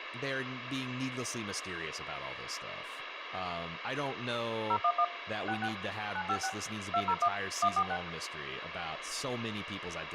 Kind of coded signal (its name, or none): DTMF